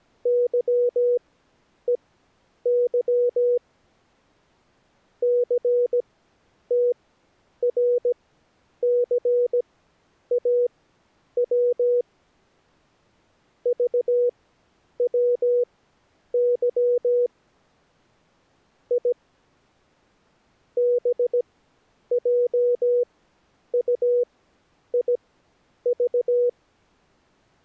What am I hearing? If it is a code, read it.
Morse code, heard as a keyed tone, machine-sent, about 17 wpm, spaced as for 9 wpm, 490 Hz. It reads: YEY CTRCAW VWY I BJUIV